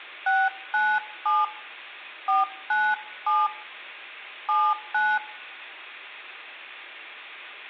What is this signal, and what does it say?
DTMF, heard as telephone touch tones, dialled by hand, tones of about 210 ms, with room echo. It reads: 697 497 79